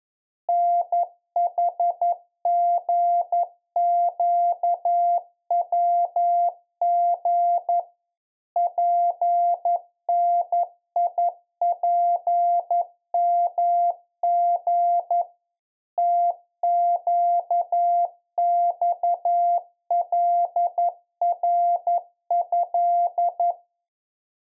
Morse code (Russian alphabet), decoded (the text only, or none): НХГЩВГ ПНИПМГ ТЩЬЛРЭ